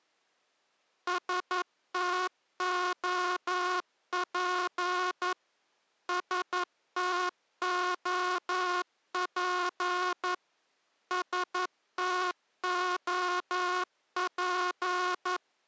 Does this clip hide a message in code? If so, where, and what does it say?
Yes: Morse code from 1.0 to 15.4 s, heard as a buzzer, machine-sent, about 11 wpm. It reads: STOP STOP STOP